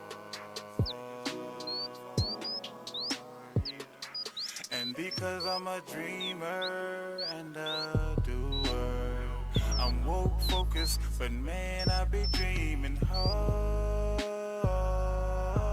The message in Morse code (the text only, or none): none